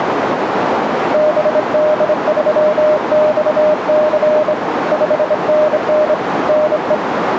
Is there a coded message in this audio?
Yes: Morse code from 1.1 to 7.0 s, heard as a keyed tone, hand-sent with a straight key, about 26 wpm, 610 Hz, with radio static and a narrow filter. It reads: BD3XC 5NN NE